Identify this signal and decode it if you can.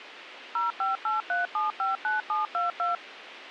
DTMF, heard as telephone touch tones, dialled by machine, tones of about 150 ms, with radio hiss. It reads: 0583759722